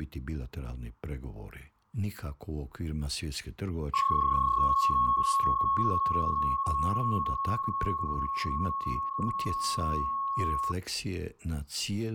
PSK31 (31.25 baud), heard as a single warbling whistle, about 1100 Hz, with fading.